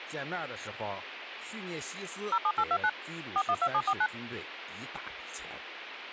DTMF, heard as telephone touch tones, dialled by machine, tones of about 60 ms, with phone line noise and speech in Chinese. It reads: 07829 412749